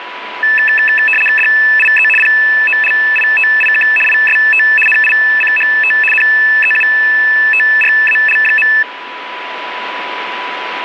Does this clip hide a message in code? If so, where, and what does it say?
Yes: RTTY (75 baud, 850 Hz shift) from 0.4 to 8.8 s, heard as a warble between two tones, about 2200 Hz centre, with radio static and a steady whistle near 990 Hz. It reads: DIE POLITIK IST NICHT NEUTRAL.